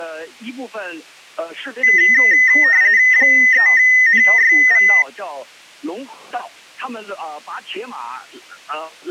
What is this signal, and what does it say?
RTTY (45.45 baud, 170 Hz shift), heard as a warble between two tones, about 1950 Hz centre. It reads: 3NYV